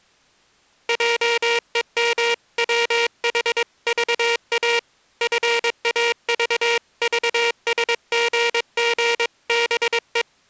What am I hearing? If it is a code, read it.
Morse code (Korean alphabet), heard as a buzzer, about 22 wpm. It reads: 함부로 놀렸다